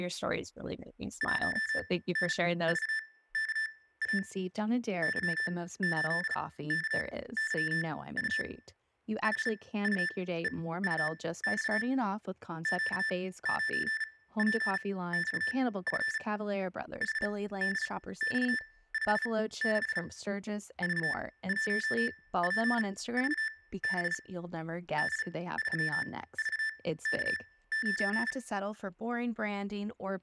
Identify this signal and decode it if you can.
Morse code, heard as electronic beeps, machine-sent, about 35 wpm, spaced as for 18 wpm, 1750 Hz, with room echo and speech in English. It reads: 1NVKA Y8KYU HUEUX Q9PXF HDX56 V1PVB D3VK9